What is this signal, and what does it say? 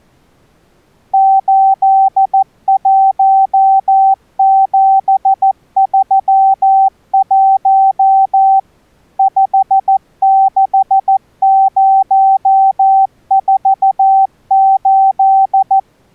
Morse code, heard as a keyed tone, machine-sent, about 14 wpm, 770 Hz. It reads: 81731 56048